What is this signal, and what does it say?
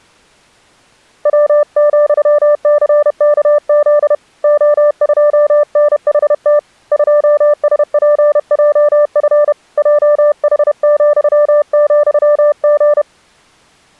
Morse code, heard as a keyed tone, hand-sent with a paddle, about 31 wpm, 590 Hz. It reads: W,CKZ O2NHT 2SPJF JH,,G